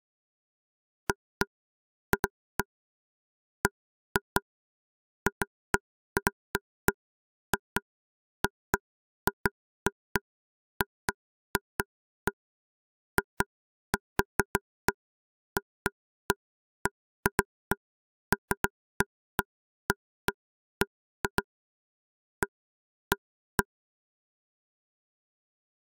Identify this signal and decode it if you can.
Irregular taps on a table. There is no code.